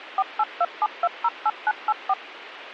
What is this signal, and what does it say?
DTMF, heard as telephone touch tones, dialled by machine, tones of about 50 ms, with radio hiss. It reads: 4827208984